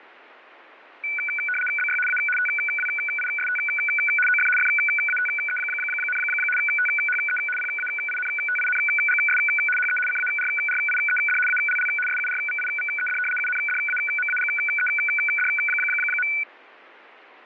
RTTY (75 baud, 850 Hz shift), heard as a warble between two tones, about 1900 Hz centre. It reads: BY A TWIST OF FATE, THE PAINTINGS HE CARRIED ALL SURVIVED UNDAMAGED.